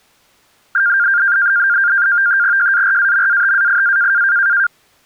NAVTEX (SITOR-B), 100 baud, 170 Hz shift, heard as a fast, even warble, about 1500 Hz centre. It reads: JARAMATAIA